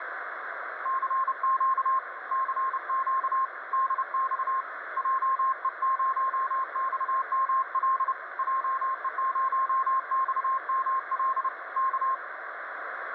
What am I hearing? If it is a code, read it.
Morse code, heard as a keyed tone, hand-sent with a paddle, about 30 wpm, 1060 Hz, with radio static. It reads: CQ CQ DX JE0XML JE0XML K